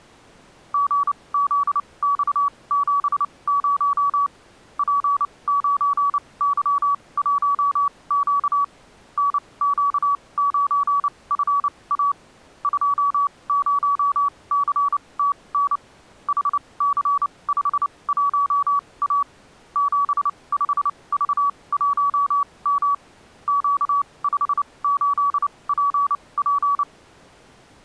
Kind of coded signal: Morse code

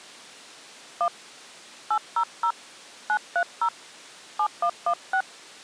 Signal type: DTMF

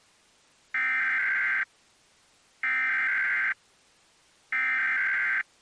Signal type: Emergency Alert System (SAME) tones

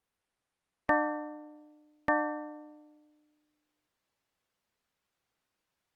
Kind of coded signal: clock strike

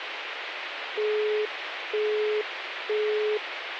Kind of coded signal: telephone call progress tone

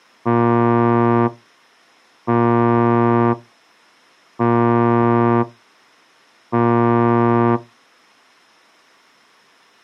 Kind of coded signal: ship horn signal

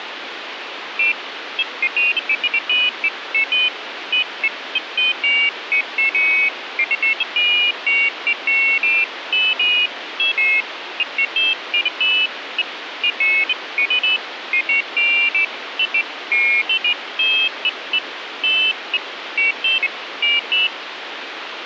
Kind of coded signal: none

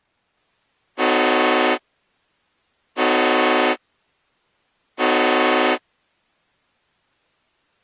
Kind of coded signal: train horn signal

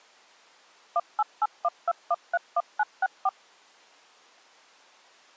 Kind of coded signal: DTMF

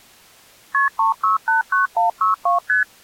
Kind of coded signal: multi-frequency trunk signalling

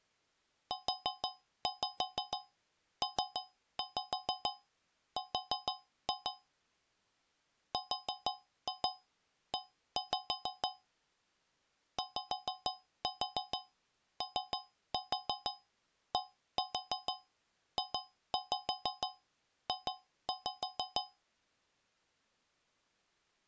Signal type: tap code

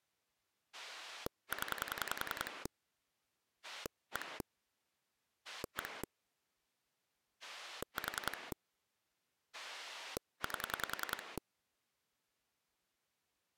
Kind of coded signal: pulse dialling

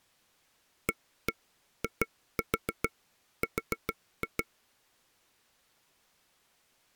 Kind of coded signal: tap code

